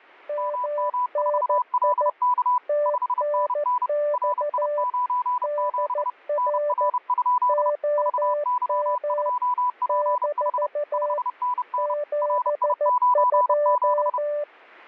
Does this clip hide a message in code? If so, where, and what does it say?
Yes: Morse code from 0.2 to 14.5 s, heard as two keyed tones. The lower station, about 14 wpm, 590 Hz: MNI TNX DR OM - 72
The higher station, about 30 wpm, 990 Hz: MM4LK 5NN RI97 NR? VY2PH 5NN RI97